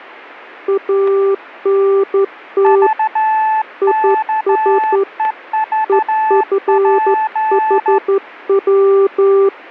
Morse code, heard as two keyed tones, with static crashes. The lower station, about 12 wpm, 390 Hz: ANT IS EFHW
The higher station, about 13 wpm, 870 Hz: VKEVP